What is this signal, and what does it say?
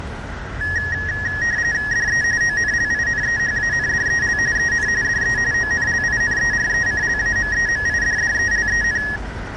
RTTY (45.45 baud, 170 Hz shift), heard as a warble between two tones, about 1800 Hz centre, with radio static and street noise. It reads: DE ONLINEHANDEL EN DE ONLINERECLAMEMIDDELEN